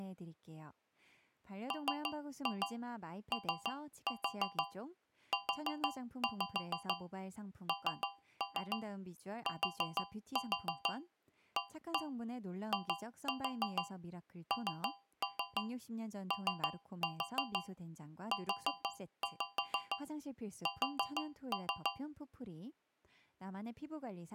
Tap code, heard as taps on a metal pipe, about 6 knocks a second, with speech in Korean. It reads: MOUNTAINOUS